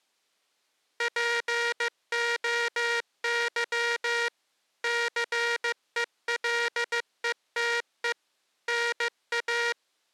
Morse code (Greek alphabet), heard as a buzzer, machine-sent, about 15 wpm. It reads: ΠΟΥ ΘΕΛΕΤΕ ΝΑ